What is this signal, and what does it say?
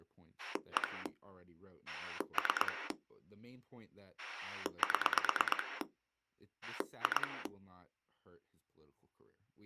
Pulse dialling, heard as a rotary dial, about 9 pulses a second, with speech in English. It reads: 1 3 7 2